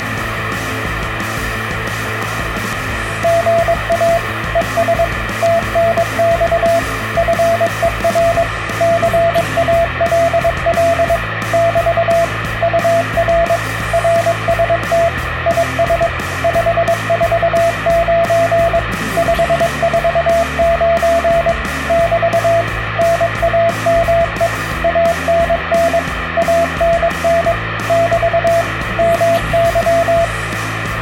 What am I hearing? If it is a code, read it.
Morse code, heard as a keyed tone, machine-sent, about 22 wpm, 670 Hz, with radio static. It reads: GA ES TNX FER CALL <BT> UR RST IS 549 549 <BT> NAME ANN ANN <BT> MY